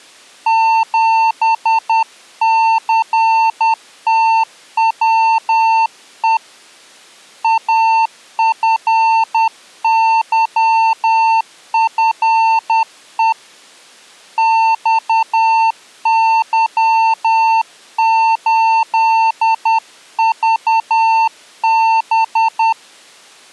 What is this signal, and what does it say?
Morse code, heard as a keyed tone, hand-sent with a paddle, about 10 wpm, 900 Hz. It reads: 7CTWE AFYFE XY8VB